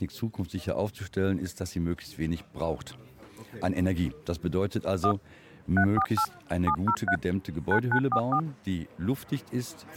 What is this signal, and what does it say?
DTMF, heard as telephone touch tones, dialled by machine, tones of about 80 ms. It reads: 1 348 703 9944